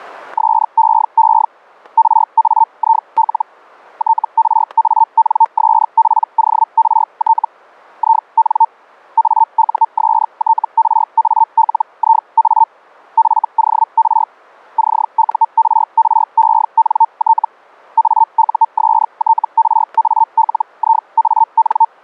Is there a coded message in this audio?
Yes: Hellschreiber (Feld-Hell, 122.5 baud) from 0.4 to 21.9 s, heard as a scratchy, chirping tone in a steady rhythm, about 900 Hz, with static crashes. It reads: SEE RAIL TRANSPORT IN AUSTRALIA FOR CURRENT AUSTRALIAN